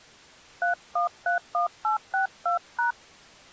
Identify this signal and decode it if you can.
DTMF, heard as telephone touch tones, dialled by hand, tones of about 120 ms. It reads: 3131862#